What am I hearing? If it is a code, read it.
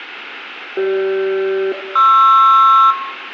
Aircraft SELCAL, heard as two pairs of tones, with room echo. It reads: CG-PR